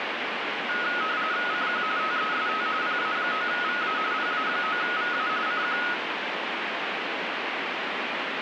RTTY (45.45 baud, 170 Hz shift), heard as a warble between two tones, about 1360 Hz centre, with radio static. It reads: CQ TEST PA9VA PA9VA CQ